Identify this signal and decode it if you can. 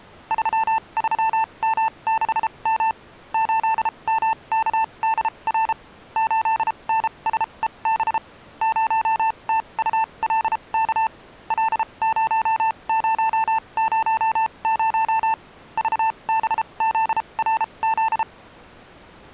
Morse code, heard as a keyed tone, machine-sent, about 33 wpm, spaced as for 26 wpm, 890 Hz. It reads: 33M6M 8MKDR 8NSEB 0TULK L0000 VBZRZ